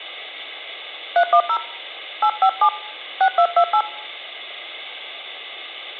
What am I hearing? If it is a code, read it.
DTMF, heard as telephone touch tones, dialled by hand, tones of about 80 ms. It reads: 310 857 6228